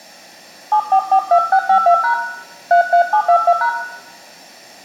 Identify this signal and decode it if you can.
DTMF, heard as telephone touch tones, dialled by hand, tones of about 80 ms, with room echo. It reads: 7442652# 33722#